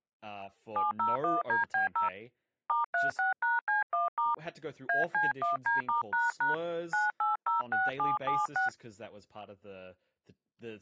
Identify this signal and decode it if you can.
DTMF, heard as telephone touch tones, dialled by hand, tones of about 160 ms, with speech in English. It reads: 701DB0 *36#C1* AC1D*## 9806776